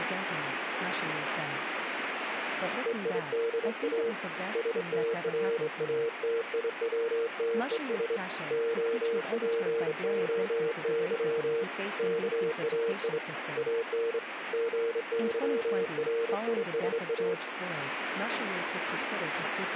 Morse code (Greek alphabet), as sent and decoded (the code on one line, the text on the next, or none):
. .. -.. .- / ... - .-. .- - .. .-- - . ... / --- .--. --- -.-- / -.- .- .. / .- -. / --. -.-- .-. .. ... .-
ΕΙΔΑ ΣΤΡΑΤΙΩΤΕΣ ΟΠΟΥ ΚΑΙ ΑΝ ΓΥΡΙΣΑ